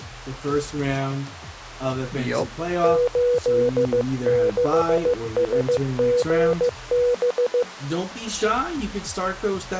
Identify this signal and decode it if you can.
Morse code, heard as a keyed tone, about 15 wpm, 490 Hz. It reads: 86SGB